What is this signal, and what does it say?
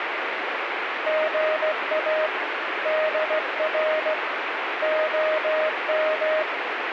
Morse code, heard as a keyed tone, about 16 wpm, 620 Hz, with radio static. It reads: GA DR OM